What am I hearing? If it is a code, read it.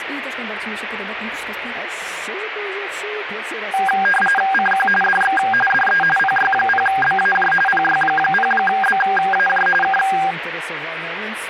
RTTY (45.45 baud, 850 Hz shift), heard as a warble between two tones, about 1200 Hz centre, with radio static. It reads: CQ DX DE PY0BAJ PY0BAJ K